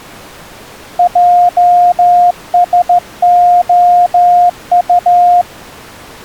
Morse code, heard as a keyed tone, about 14 wpm, 710 Hz. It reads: JSOU